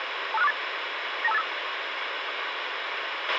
Five-tone selective call (EIA), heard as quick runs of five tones, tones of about 30 ms, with radio hiss and a squelch burst at the end. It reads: 25648 92585